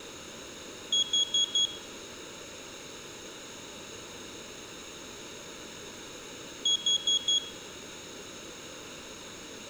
Alarm pattern, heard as an alarm's beeps, played twice, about 3300 Hz, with room echo. Temporal four. Carbon monoxide.